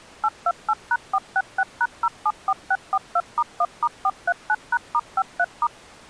DTMF, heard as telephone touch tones, dialled by machine, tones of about 50 ms. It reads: 828#466#074642*1*439#*53*